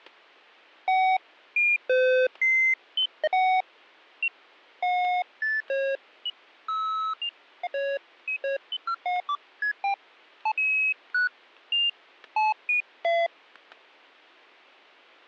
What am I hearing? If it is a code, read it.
Electronic bleeps of random pitch and length, with static crashes. There is no code.